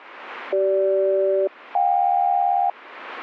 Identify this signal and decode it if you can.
Aircraft SELCAL, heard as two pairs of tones. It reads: CG-JK